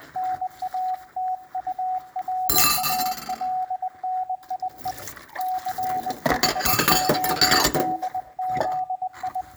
Morse code, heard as a keyed tone, hand-sent with a bug key, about 20 wpm, 740 Hz, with room echo and kitchen noise. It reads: NATURALNIE CHODZI